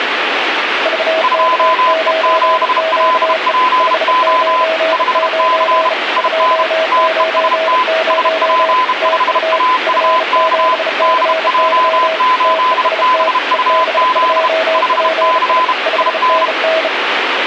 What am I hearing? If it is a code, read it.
Morse code, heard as two keyed tones, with radio static. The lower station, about 34 wpm, 640 Hz: VK9QE 599 290 TU F7CY TEST EB2PI 5NN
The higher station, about 32 wpm, 1010 Hz: 2E7LPO 5C IN TEST SP5AUK DJ8BUZ 5C IN